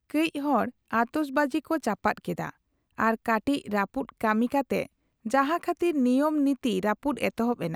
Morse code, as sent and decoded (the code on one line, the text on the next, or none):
none